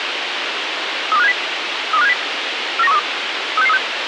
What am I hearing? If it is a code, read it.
Five-tone selective call (EEA), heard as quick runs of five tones, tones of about 40 ms, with radio hiss. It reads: 32570 32570 49132 36636